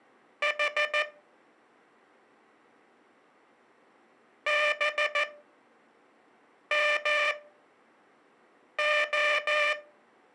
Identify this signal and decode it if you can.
Morse code, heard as a buzzer, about 14 wpm, spaced as for 5 wpm. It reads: H BMO